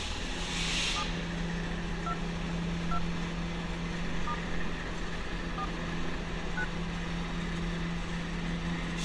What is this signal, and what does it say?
DTMF, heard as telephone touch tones, dialled by hand, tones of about 70 ms, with street noise. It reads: 7 2 2 * 4 9